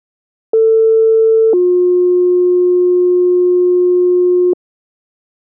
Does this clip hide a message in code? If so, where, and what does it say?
Yes: two-tone page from 0.5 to 4.5 s, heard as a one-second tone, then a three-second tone, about 450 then 360 Hz.